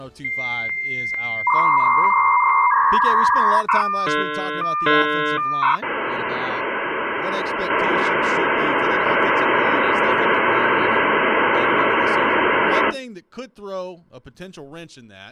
Dial-up modem handshake (V.34 or later), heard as a whistle, warbles, then hiss.